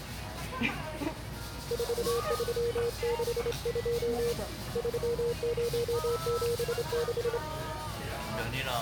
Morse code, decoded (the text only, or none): 4362 3076